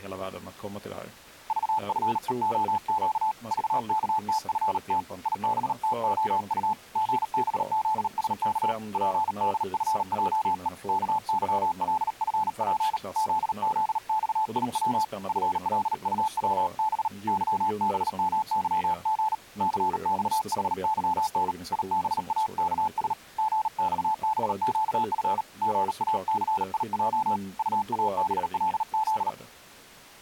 Morse code, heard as a keyed tone, hand-sent with a paddle, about 38 wpm, 870 Hz, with speech in Swedish. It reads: VFEOQ VKTFT IBTOU GBZSK PDFJE KYLFP ZZXIW FLUWB YBMYG CXHYN IBAKS GXBQF GACIJ UABLZ